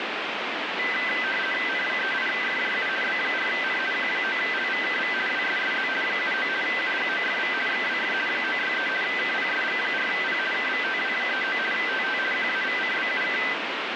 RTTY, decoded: N38FJU B4N Q9LVKV WSSZ 79 UGOFV XWF 963 KPSG4P KVTW39 TT QAVCBUK

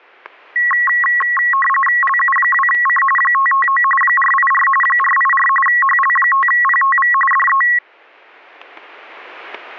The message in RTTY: LU2C 559 484 484 HL5PTV DE

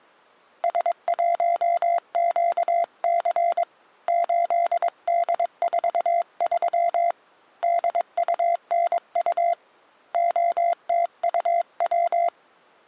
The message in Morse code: S1QC 8D43 DUNU OTUW

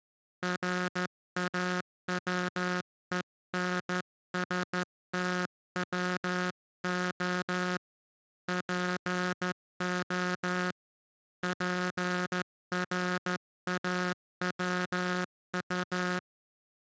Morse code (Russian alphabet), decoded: РАВЕНСТВО ПО ПРАВУ

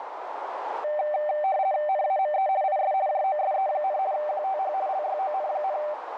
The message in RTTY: NAME IS JOSE, QTH LYON,

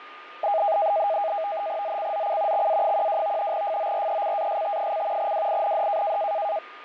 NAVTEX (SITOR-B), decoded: ZCZC XA12 FORECAST: WIND

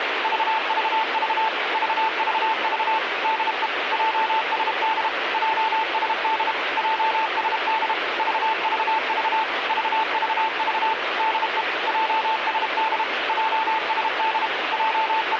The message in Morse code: VVV VVV DE JSD JSD JSD VVV VVV DE JSD JSD …

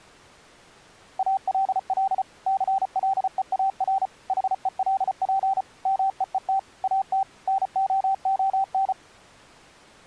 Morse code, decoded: ALL CLEAR HELP MEET AT NOON

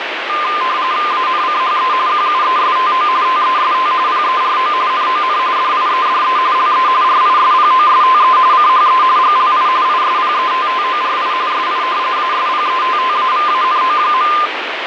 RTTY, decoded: ANCHE QUESTO TEST PERO NON DIEDE LE RISPOSTE CHE GLI ISPETTORI SI ASPETTAVANO.

